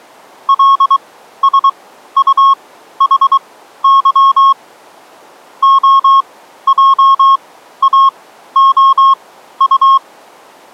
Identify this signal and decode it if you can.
Morse code, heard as a keyed tone, machine-sent, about 23 wpm, spaced as for 13 wpm, 1090 Hz. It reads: LSUHY OJAOU